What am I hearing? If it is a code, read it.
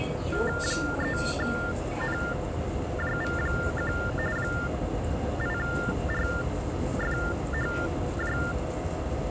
TTY/TDD text telephone tones (45.45 baud Baudot), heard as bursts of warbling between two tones, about 400 Hz shift, 1600 Hz centre, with the noise inside a subway train. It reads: 3NJV1 8RFHJ